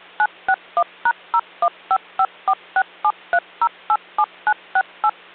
DTMF, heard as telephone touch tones, dialled by machine, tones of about 60 ms, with hum. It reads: 961#01554673087968